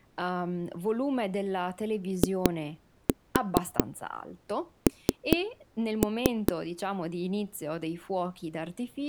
Tap code, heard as knocks on a wall, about 4 knocks a second, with speech in Italian. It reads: IN